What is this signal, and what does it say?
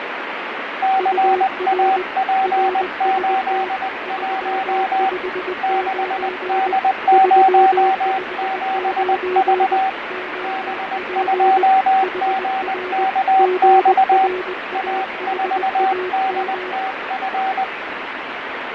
Morse code, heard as two keyed tones, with heavy radio static and fading. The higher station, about 20 wpm, 770 Hz: CAP81 6D07V B2GKX A4DTF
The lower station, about 20 wpm, 370 Hz: UR RST 359 359 OP HR GRAHAM